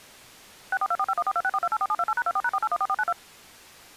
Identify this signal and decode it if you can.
DTMF, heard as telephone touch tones, dialled by machine, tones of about 50 ms. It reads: 6424514264284728#24#4814492